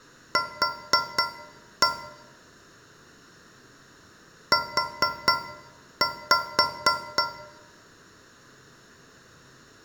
Tap code, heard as taps on a metal pipe, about 4 knocks a second, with room echo. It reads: Q U